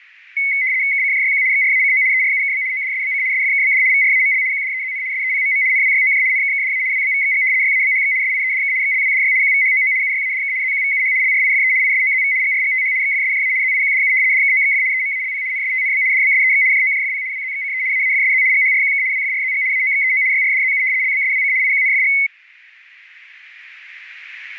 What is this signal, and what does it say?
RTTY (75 baud, 170 Hz shift), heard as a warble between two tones, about 2150 Hz centre, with radio static. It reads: KCJYQ XRACO ERUKB ODSBC SFKBD VRAML QDEZN SEPMM NWYOJ NKKDA WBVXG YABHX SIEDK XLWDY QVHOO UYADK ZQVUH LRIFE ISOZV GRGTH XFSJA ZIQDU DKOXF EMALP NSTNB DBSEX JOJFP WZXCE AAFSZ GHRQK WFRZG AOXEO YRDZU LBSWC IQNFG